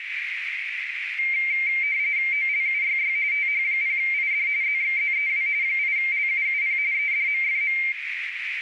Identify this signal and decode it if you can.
RTTY (45.45 baud, 170 Hz shift), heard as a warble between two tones, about 2200 Hz centre, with radio static and a narrow filter. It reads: OLUYY TH0ID ZXZEW 8LUUP EDMFM